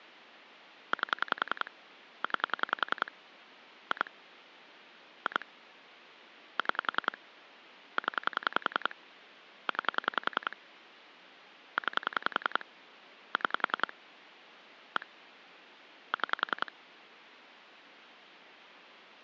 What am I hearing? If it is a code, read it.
Pulse dialling, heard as clicks on a phone line, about 10 pulses a second. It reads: 8 9 2 2 6 0 9 9 6 1 6